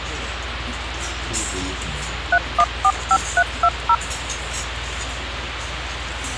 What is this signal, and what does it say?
DTMF, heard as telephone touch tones, dialled by machine, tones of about 60 ms, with radio hiss and the noise of a restaurant. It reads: 3145320